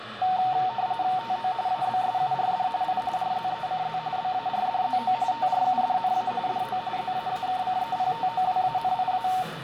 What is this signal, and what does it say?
RTTY (45.45 baud, 170 Hz shift), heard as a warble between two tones, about 830 Hz centre, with radio static, room echo and the noise of a crowd indoors. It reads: TO ABSURD I RZECZ BARDZO TRUDNA DO ZAAKCEPTOWANIA